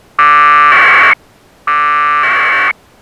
Packet radio (AX.25, as in APRS), 1200 baud, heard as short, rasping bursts.